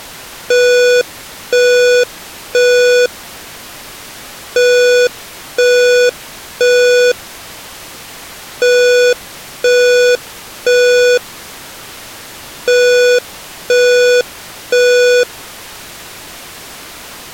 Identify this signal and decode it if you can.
Alarm pattern, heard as an alarm's beeps, played four times, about 490 Hz. Temporal three. Smoke or fire, evacuate.